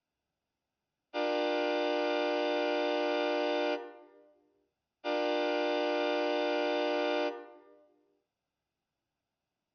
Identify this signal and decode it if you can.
Train horn signal, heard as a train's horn, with room echo. 2 long. On North American railways: brakes released, proceed.